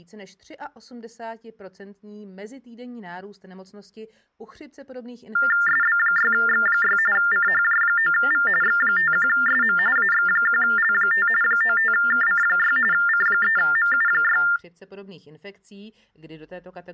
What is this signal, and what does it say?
TTY/TDD text telephone tones (45.45 baud Baudot), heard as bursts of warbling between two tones, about 400 Hz shift, 1600 Hz centre. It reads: SB6X6 CHJ9V X51SM AX1L5 95KC6 C3MU6